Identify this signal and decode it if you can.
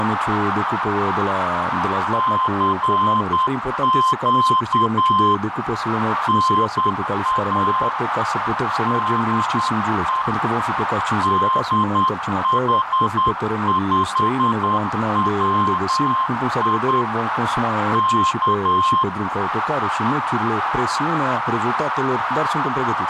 Morse code, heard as a keyed tone, hand-sent with a straight key, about 10 wpm, 1050 Hz, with heavy radio static and a narrow filter. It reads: CQ NA DE DH5WI K